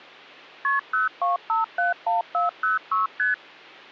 Multi-frequency trunk signalling (R1, as on North American trunks), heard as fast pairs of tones, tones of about 150 ms, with hum. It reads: KP 02571406 ST